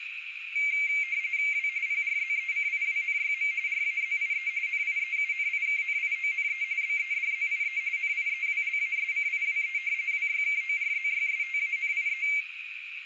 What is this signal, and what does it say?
RTTY (45.45 baud, 170 Hz shift), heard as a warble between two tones, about 2200 Hz centre, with radio static and a narrow filter. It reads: W PRZECIWNYM RAZIE NIEUNIKNIONE BEDZIE NIEWLASCIWE WYKORZYSTANIE